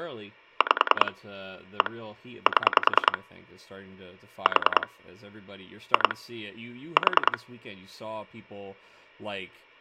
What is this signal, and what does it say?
Pulse dialling, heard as clicks on a phone line, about 10 pulses a second, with hum and speech in English. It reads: 5 1 7 4 2 4